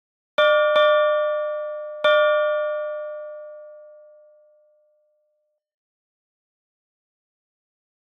Ship's bell, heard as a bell. 3. Three half-hours of the watch have passed.